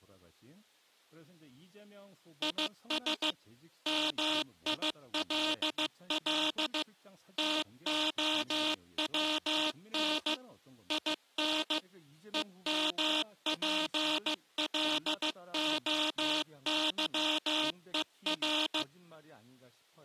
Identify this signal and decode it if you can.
Morse code, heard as a buzzer, machine-sent, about 15 wpm, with speech in Korean. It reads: IS MILL TOWN IN EMPLOYER